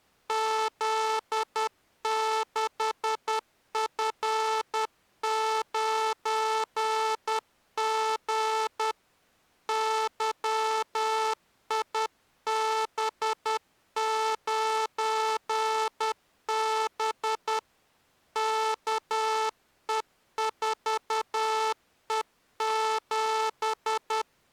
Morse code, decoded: Z6F9G YIB9B KE4E7

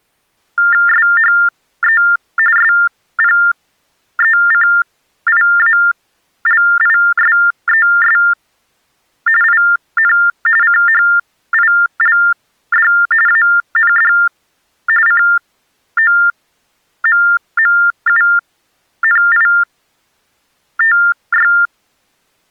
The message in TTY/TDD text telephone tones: SHE SPECIALISES IN CHILD AND COMMUNITY

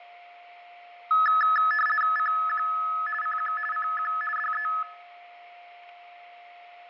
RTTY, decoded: CQ CQ CQ DE

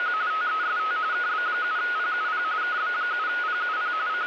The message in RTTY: … TEST KB7PUP KB7PUP …

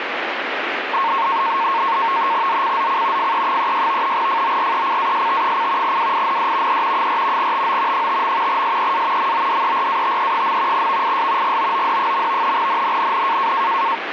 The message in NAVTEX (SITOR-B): ZCZC FE36 FORECAST: WIND E 4 TO 5. SEA MODERATE. VIS GOOD. NNNN

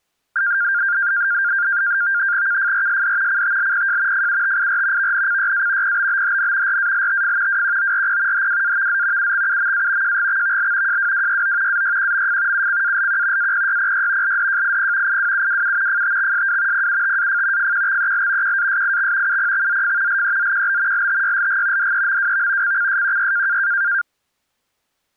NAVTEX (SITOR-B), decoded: KFRSD CTLPJ FUTIR VNCYA PBBHN RALTF WQORP HWAVZ UXUMA JGXVL JWWYO AYQMF UCALQ APYPY LDJIP IWUWU FTXSW PUTAF FQXEL QASIX UPXZF LEZQB LTYLG DEMWV CCSQY

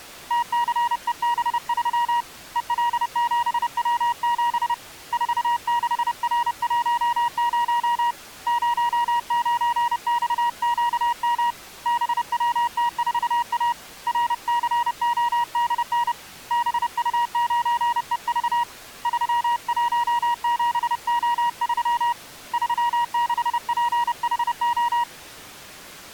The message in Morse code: TCEB3 EL7W7 46R10 09XQM BWT4A RCODN BU9EV 317O3 36PHO

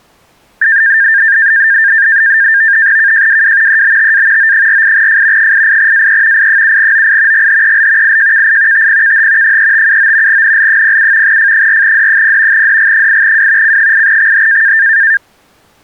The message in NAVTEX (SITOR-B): KJWW EBTA O48F 88AE I7OI GHEL IJKI TPKH 3579 NL07 F4D0 DG8W C8XH

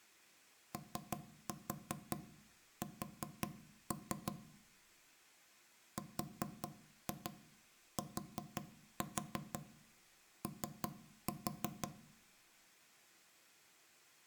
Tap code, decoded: OS RTO

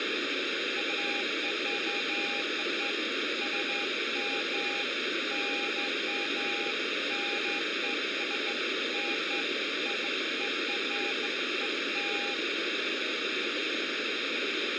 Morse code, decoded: none

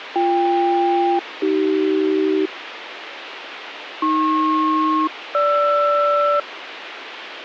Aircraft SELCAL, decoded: BK-AC AP-GR

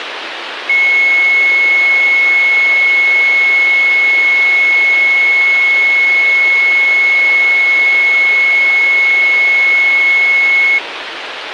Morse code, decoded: none

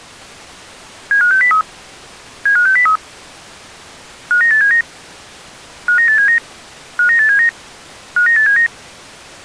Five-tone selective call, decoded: 75603 75603 59879 59879 59879 59879

